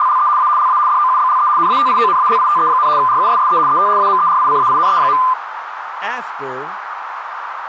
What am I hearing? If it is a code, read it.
RTTY (75 baud, 170 Hz shift), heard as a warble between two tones, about 1110 Hz centre, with radio static, a narrow filter and speech in English. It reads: … A LA DOUBLE NATIONALITE, RUSSE ET AMERICAINE.